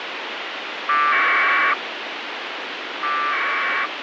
Packet radio (AX.25, as in APRS), 1200 baud, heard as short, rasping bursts, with radio hiss.